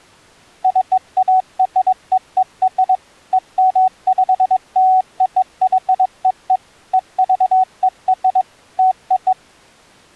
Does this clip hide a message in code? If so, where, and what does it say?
Yes: Morse code (American railroad code) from 0.6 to 9.4 s, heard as a keyed tone, machine-sent, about 750 Hz. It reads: CAREER EMPLOYEE EVER TO